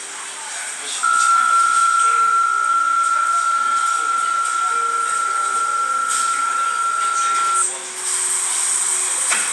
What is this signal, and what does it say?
PSK63 (62.5 baud), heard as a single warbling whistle, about 1360 Hz, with the noise of a cafe.